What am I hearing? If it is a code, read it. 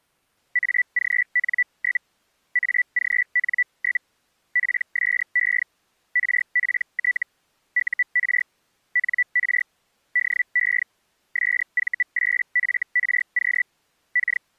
Hellschreiber (Feld-Hell, 122.5 baud), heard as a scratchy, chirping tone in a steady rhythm, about 1950 Hz. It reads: AGN? AGN? PSE RPT UR NR DE SV8FRQ K